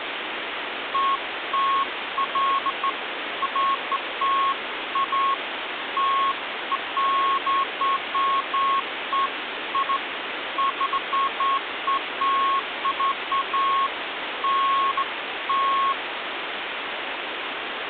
Beeps of irregular length, with phone line noise. There is no code.